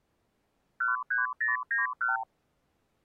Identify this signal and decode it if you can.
Multi-frequency trunk signalling (R2, with the far end's replies), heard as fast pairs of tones, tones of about 150 ms. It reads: 13091